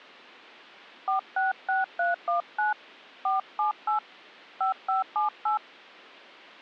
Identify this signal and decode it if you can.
DTMF, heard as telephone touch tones, dialled by hand, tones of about 130 ms. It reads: 466319 478 5578